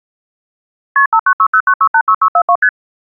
Multi-frequency trunk signalling (R1, as on North American trunks), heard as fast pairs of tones, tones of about 70 ms. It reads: KP 59609686642 ST